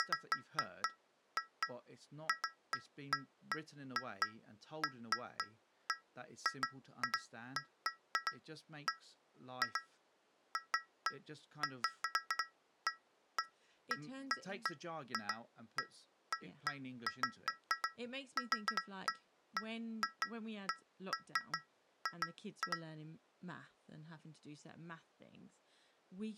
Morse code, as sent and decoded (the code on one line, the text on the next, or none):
none